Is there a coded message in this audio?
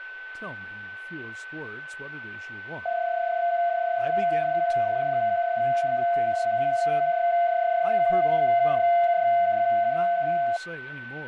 Yes: PSK31 (31.25 baud) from 2.9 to 10.6 s, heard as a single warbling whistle, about 690 Hz, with a steady whistle near 1520 Hz and speech in English.